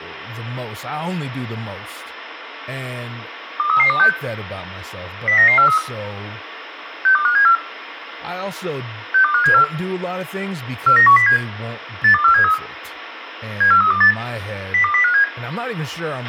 Five-tone selective call (CCIR), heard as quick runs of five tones, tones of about 100 ms, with radio hiss, a squelch burst at the end and speech in English. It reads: 23326 09943 62574 62574 49107 82473 74328 02057